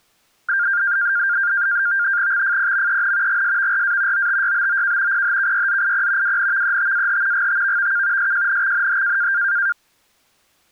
NAVTEX (SITOR-B), 100 baud, 170 Hz shift, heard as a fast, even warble, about 1500 Hz centre. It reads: XFPMEN GSVRA OTYBOK PHKYZIP WNVETAH GTVVK SJNXNH